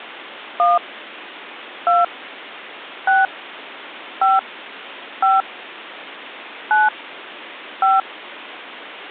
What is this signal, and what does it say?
DTMF, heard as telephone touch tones, dialled by hand, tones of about 180 ms. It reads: 1 2 6 5 5 9 5